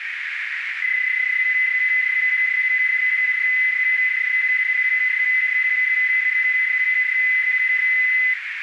PSK31 (31.25 baud), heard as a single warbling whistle, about 2000 Hz, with radio static and a narrow filter.